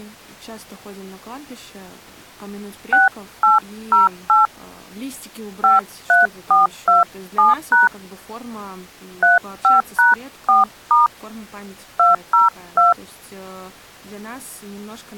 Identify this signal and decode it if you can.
DTMF, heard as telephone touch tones, dialled by hand, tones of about 150 ms, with speech in Russian. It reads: 6808 53427# 35#4* 202